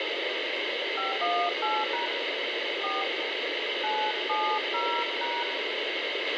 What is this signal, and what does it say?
DTMF, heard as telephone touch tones, dialled by hand, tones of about 230 ms, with radio hiss, a squelch burst at the end and room echo. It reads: 518# 4 970#